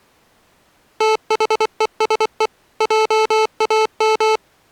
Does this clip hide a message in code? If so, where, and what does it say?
Yes: Morse code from 0.9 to 4.4 s, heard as electronic beeps, machine-sent, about 24 wpm, 440 Hz. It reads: THESE JAM